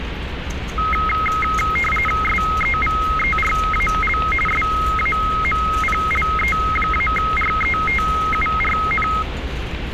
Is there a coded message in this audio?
Yes: RTTY (45.45 baud, 850 Hz shift) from 0.8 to 9.2 s, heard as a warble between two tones, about 1700 Hz centre, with radio static and street noise. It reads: SEVERAL SAMPLE-RETURN